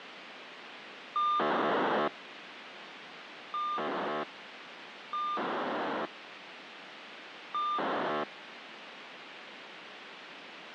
POCSAG pager data (2400 baud), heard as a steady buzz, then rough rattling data, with radio hiss.